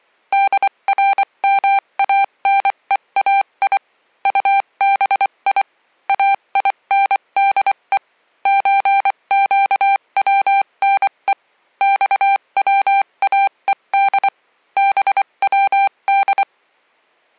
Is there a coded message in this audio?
Yes: Morse code (Persian alphabet) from 0.3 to 16.5 s, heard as a keyed tone, machine-sent, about 24 wpm, spaced as for 21 wpm, 790 Hz. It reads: درمانهای طبی اینده چگونه خواهد بود